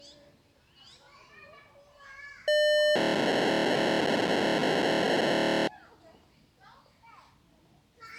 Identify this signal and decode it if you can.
POCSAG pager data (1200 baud), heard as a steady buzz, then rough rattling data, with the noise of a park.